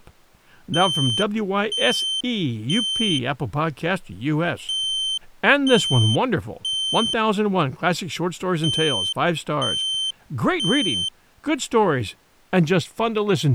Alarm pattern, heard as an alarm's beeps, played three times, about 3100 Hz, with speech in English. Temporal three. Smoke or fire, evacuate.